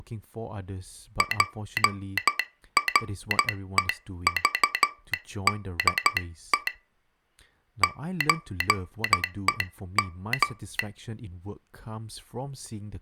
Morse code (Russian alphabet), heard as a telegraph sounder, hand-sent with a straight key, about 12 wpm, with speech in English. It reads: ПРЕЖДЕ ЧЕМ